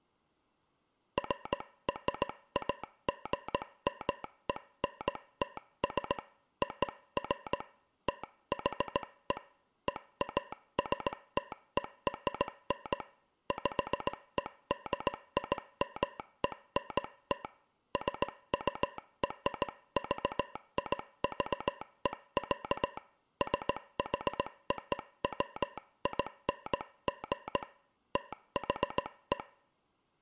Morse code (American railroad code), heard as a telegraph sounder, hand-sent with a straight key, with room echo. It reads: FRAGMENTS OF THE EASTERN PEDIMENT SURVIVE, SHOWING THE